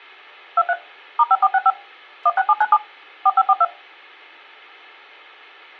DTMF, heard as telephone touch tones, dialled by machine, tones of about 50 ms. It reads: 23 *5465 16797 4542